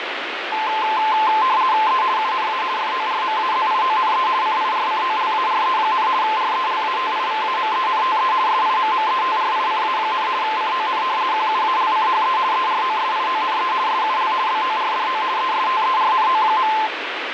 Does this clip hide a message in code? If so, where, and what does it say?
Yes: RTTY (50 baud, 170 Hz shift) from 0.5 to 16.9 s, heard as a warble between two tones, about 960 Hz centre, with radio static. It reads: E UNA FORMAZIONE CIRCOLARE, RELATIVAMENTE SIMMETRICA, CON QUALCHE EROSIONE SUL BORDO ESTERNO.